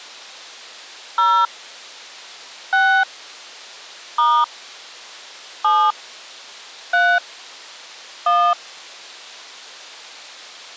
DTMF, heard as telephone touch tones, dialled by hand, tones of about 260 ms. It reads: 0 6 * 7 3 1